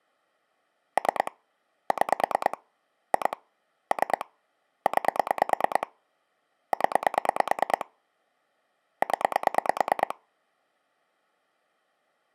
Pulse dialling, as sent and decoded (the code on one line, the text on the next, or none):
3 / 6 / 2 / 3 / 9 / 10 / 10
3 6 2 3 9 0 0